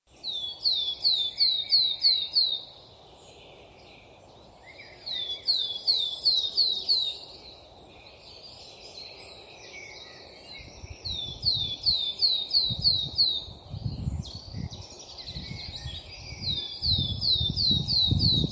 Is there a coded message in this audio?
No.